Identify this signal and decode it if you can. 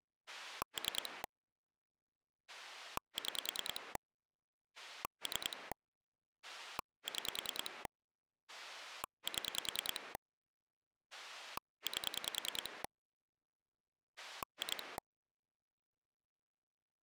Pulse dialling, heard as a rotary dial, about 10 pulses a second. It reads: 3 6 3 6 7 8 2